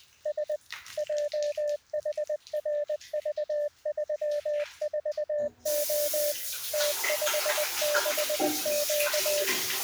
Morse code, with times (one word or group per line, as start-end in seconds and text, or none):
0.3-0.6 S
1.0-6.3 JHRV34O
6.7-9.4 T56Q